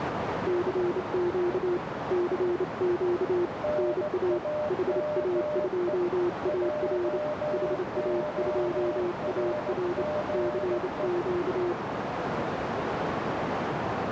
Morse code, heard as two keyed tones, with heavy radio static and a narrow filter. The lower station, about 28 wpm, 350 Hz: CQ CQ NA HA2AR HA2AR CQ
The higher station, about 17 wpm, 600 Hz: NAME JORGE